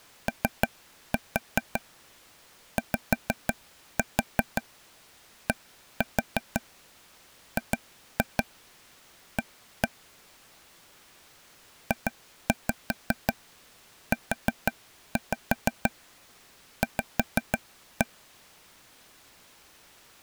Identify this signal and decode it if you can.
Tap code, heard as taps on a table, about 5 knocks a second. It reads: OYDGA JUV